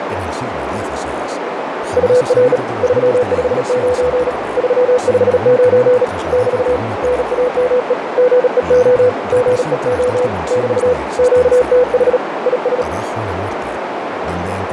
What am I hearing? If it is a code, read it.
Morse code, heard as a keyed tone, hand-sent with a bug key, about 37 wpm, 500 Hz, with radio static and a narrow filter. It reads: UR 359 359 <BT> NAME GEO GEO <BT> QTH IS